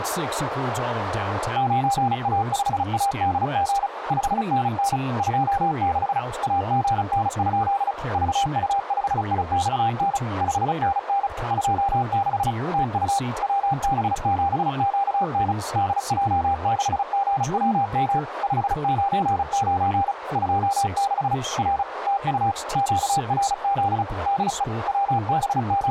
Morse code, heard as a keyed tone, machine-sent, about 35 wpm, 800 Hz, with radio static, a narrow filter and speech in English. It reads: 9A5ADG 5NN 26 AGN? VU5IXN 5NN 26 TU WB7QN DJ6GWM 599 26 R TU QRZ DE …